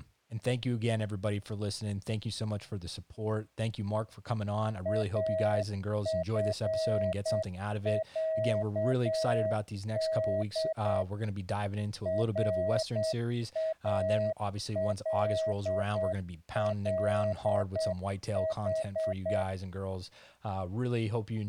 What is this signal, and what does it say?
Morse code (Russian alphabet), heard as a keyed tone, machine-sent, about 8 wpm, 640 Hz, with speech in English. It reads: АФЯД РАЛЛХ